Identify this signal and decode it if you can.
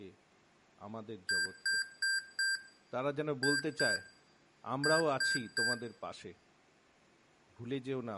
Beep code, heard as beeps from a small speaker, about 1600 Hz, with room echo and speech in Gujarati. 4-2-3. In Phoenix BIOS tables: gate A20 failure.